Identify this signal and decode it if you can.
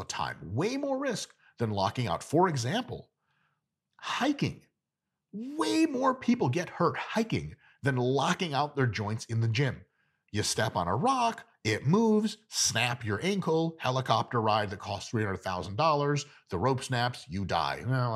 Speech in English. There is no code.